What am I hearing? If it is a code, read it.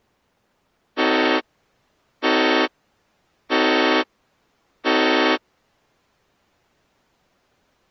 Train horn signal, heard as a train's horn. 4 short. On North American railways: a request for a signal to be given or repeated.